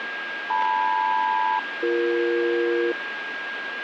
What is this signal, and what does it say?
Aircraft SELCAL, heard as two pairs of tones, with radio static and a steady whistle near 1620 Hz. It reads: LM-BE